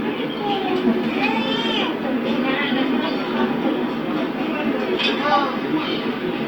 The noise of a park. There is no code.